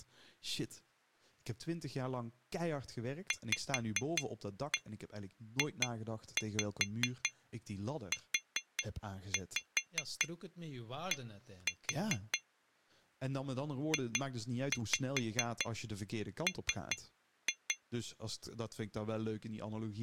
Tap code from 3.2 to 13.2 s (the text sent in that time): VJUD